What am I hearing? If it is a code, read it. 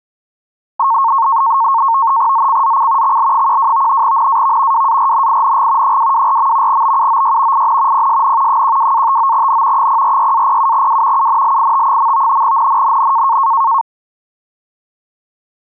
NAVTEX (SITOR-B), 100 baud, 170 Hz shift, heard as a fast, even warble, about 1000 Hz centre. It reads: ZCZC XL12 NAV WARNING 224. BUOY IN PSN 12-59N 046-07W UNLIT. NNNN